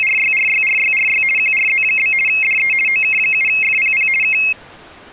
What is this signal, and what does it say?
RTTY (50 baud, 450 Hz shift), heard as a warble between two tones, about 2350 Hz centre. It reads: … QRZ? DE OK7FPP K